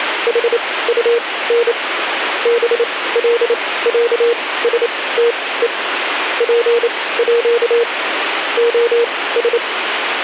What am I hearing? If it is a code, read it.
Morse code (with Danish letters), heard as a keyed tone, machine-sent, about 28 wpm, spaced as for 18 wpm, 470 Hz, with radio static. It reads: HUN BLÆSTE PÅ OS